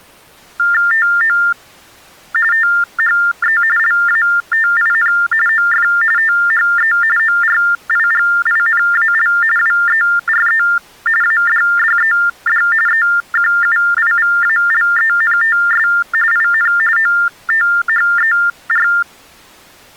TTY/TDD text telephone tones (45.45 baud Baudot), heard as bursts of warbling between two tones, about 400 Hz shift, 1600 Hz centre. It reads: TO THE LATIN OF THE ORIGINAL WERE ADDED EQUIVALENTS IN OTHER